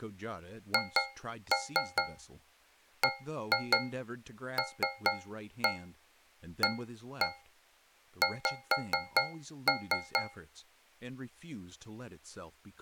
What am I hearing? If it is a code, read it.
Tap code, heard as taps on a metal pipe, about 4 knocks a second, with speech in English. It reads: HBLAX